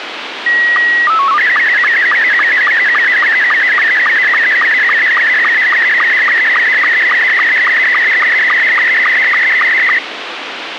SSTV (slow-scan television), Scottie S2, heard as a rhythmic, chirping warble, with radio hiss.